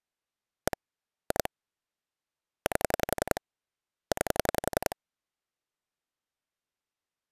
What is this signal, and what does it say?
Pulse dialling, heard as clicks on a phone line, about 11 pulses a second. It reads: 1 2 8 9